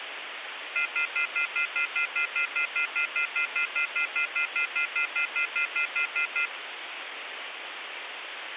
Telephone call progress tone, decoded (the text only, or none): off-hook warning tone